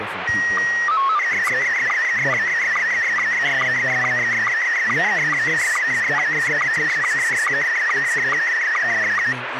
SSTV (slow-scan television), Scottie S1, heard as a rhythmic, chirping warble, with radio static and speech in English.